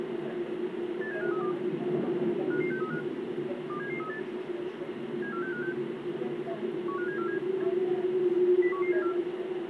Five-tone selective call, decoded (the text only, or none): 87532 55635 27738 74656 15747 01174